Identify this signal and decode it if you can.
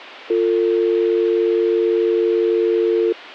Telephone call progress tone (North American or UK plan), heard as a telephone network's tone, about 350, 450 Hz. Dial tone.